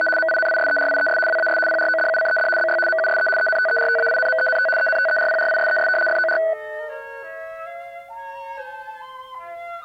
RTTY (75 baud, 850 Hz shift), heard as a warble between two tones, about 1070 Hz centre. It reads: … MINISERIES WAS PRODUCED BY MUSE ENTERTAINMENT ENTERPRISES FOR